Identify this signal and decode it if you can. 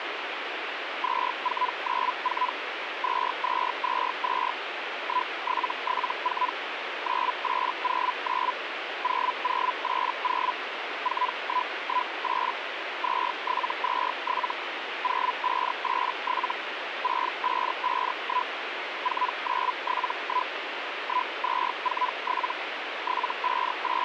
Hellschreiber (Feld-Hell, 122.5 baud), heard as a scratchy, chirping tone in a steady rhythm, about 1000 Hz, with radio static. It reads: 2494 2222 1774 9809 0080 4118 2727 0587 6551 4971 1247 …